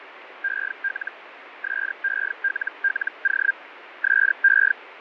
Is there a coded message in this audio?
Yes: Hellschreiber (Feld-Hell, 122.5 baud) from 0.4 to 4.7 s, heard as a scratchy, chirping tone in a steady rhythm, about 1600 Hz, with radio static and fading. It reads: EL SELLO SE